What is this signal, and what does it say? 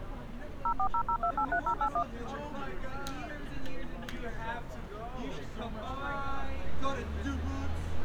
DTMF, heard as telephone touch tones, dialled by machine, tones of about 80 ms, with street noise. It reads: 0400283081